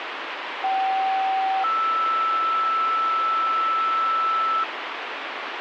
Two-tone page, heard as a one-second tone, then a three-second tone, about 770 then 1320 Hz, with radio hiss.